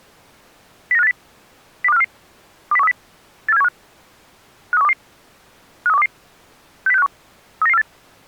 Five-tone selective call (EEA), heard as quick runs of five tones, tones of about 40 ms. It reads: 09580 02544 20130 84715 53122 53122 60651 39948